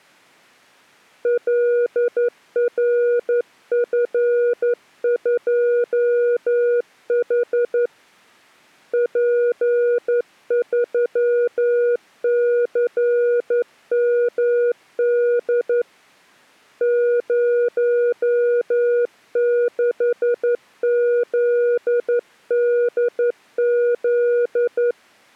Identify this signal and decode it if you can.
Morse code, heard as a keyed tone, hand-sent with a straight key, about 11 wpm, 480 Hz. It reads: LRF2H P3CMD 06ZDZ